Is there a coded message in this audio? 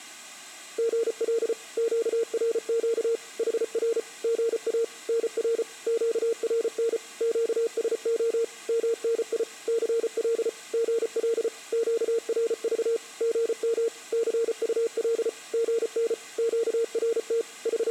Yes: Morse code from 0.7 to 17.9 s, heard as a keyed tone, machine-sent, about 34 wpm, 460 Hz. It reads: GL QRQ HR GA NR QRN QSO MNI CL GL QRV GM CUL GN QRT …